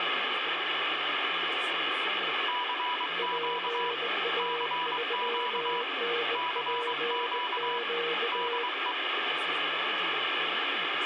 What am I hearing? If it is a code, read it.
Morse code, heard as two keyed tones, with radio static and speech in English. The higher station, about 23 wpm, 980 Hz: CQ CQ CQ DE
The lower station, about 19 wpm, 470 Hz: PA3NPQ